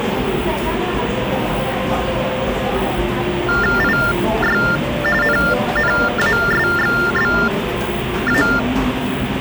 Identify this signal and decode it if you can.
TTY/TDD text telephone tones (45.45 baud Baudot), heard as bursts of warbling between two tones, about 400 Hz shift, 1600 Hz centre, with phone line noise and the noise of a cafe. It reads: IY NNASXBA